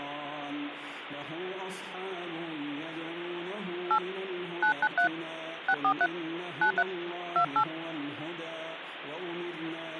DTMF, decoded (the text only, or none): 8 993 643 93 28